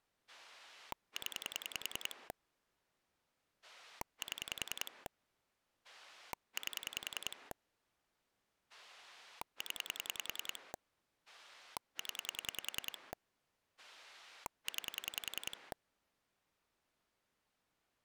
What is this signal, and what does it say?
Pulse dialling, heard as a rotary dial, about 10 pulses a second. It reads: 0 7 8 0 0 9